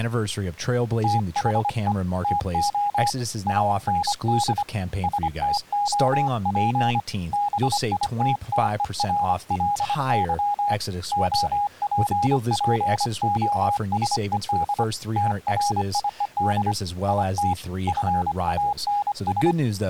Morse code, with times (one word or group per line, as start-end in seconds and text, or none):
1.0-1.9 THE
2.2-3.1 TO
3.5-4.6 AND
5.0-7.0 STOP
7.3-10.7 BITTERLY
11.1-14.8 OPPOSED
15.2-16.7 TRIED
17.1-17.5 IT
17.9-19.5 FANS